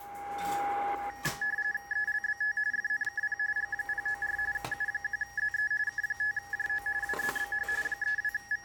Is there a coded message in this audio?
Yes: RTTY (45.45 baud, 170 Hz shift) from 1.1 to 8.6 s, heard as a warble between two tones, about 1800 Hz centre, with a steady whistle near 810 Hz, room echo and the noise of a restaurant. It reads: ELBT FNKP G094 U1ZE K5JO WZBH …